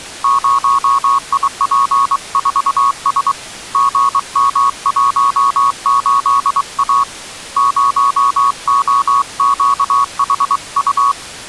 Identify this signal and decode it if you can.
Morse code, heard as a keyed tone, hand-sent with a paddle, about 23 wpm, 1110 Hz. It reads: 0IP4S GM18A 0OQHU